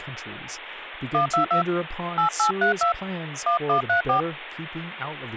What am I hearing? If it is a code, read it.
DTMF, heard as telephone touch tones, dialled by hand, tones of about 110 ms, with phone line noise and speech in English. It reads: 122 8832 1134